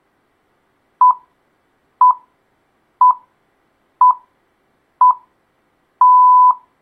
Radio time signal (six pips, as the Greenwich Time Signal), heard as pips.